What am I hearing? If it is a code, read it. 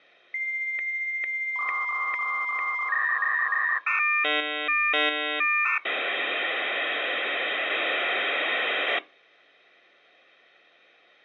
Dial-up modem handshake (V.34 or later), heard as a whistle, warbles, then hiss, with hum.